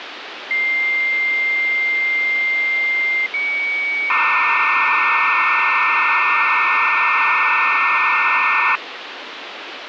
Dial-up modem handshake (low-speed, two carriers), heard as two whistles, then hiss, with phone line noise.